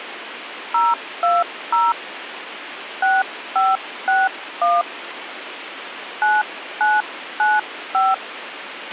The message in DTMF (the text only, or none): 020 6561 9995